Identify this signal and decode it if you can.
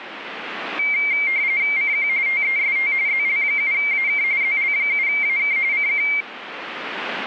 RTTY (45.45 baud, 170 Hz shift), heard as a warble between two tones, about 2200 Hz centre, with radio static. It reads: CQ TEST ZL7AK ZL7AK CQ